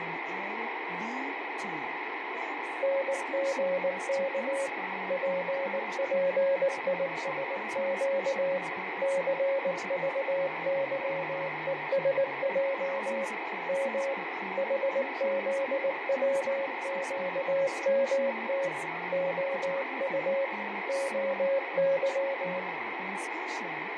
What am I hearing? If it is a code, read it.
Morse code, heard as a keyed tone, machine-sent, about 19 wpm, 550 Hz, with radio static, fading and room echo. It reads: NGK PPISQ CVYESJ M HZWQMT OU OY